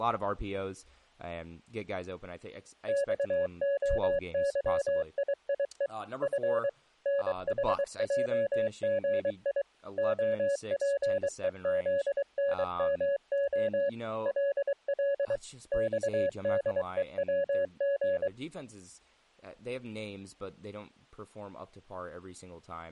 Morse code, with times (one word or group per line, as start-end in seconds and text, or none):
2.9-5.9 XOYIIE
6.2-6.7 F
7.1-9.6 NHJGI
10.0-13.9 OPEZNMO
14.3-15.4 LL
15.7-18.3 XDEWG